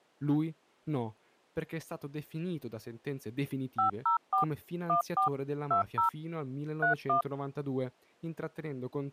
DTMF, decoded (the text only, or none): 504 14 20 31